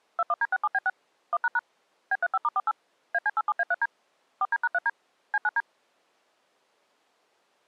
DTMF, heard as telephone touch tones, dialled by machine, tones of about 40 ms. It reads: 21D67B6 1## B35*48 AC87A3D 4D#3D C9D